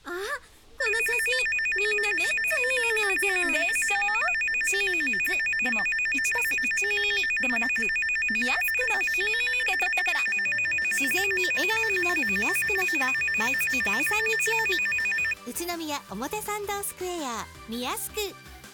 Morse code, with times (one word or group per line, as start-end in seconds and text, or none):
none